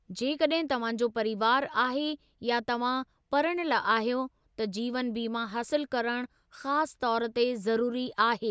Speech in Sindhi. There is no code.